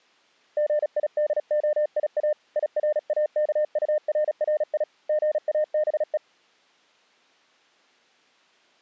Morse code, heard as a keyed tone, hand-sent with a paddle, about 36 wpm, 600 Hz. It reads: GIDOIA IRAKURRI GABE